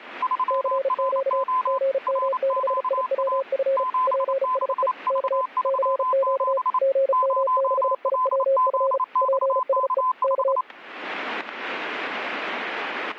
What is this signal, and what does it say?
Morse code, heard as two keyed tones, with static crashes. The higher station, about 28 wpm, 1020 Hz: 3RO RQA 76V37 0LZXK5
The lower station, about 35 wpm, 540 Hz: CQ GM6IWF PSE K CQ GM6IWF PSE K